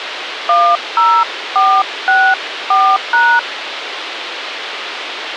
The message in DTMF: 10464#

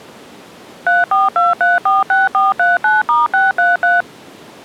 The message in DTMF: 342346439*633

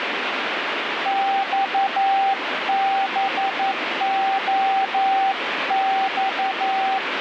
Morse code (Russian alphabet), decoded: ЬБОЬ

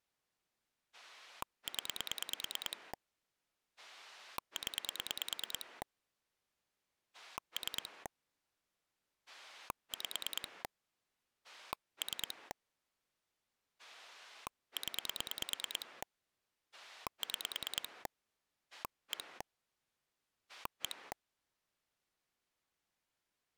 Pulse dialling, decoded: 0 0 3 5 3 0 6 1 1

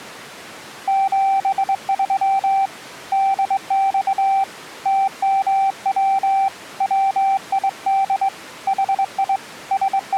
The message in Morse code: 73 DX TMW WID HI …

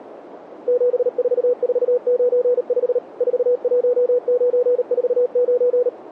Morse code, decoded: 74495 41949

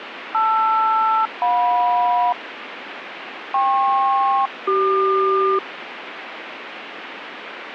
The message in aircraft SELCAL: LR-JM KP-CQ

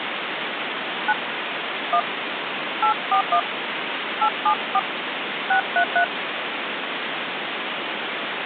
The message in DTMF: 9 1 841 874 633

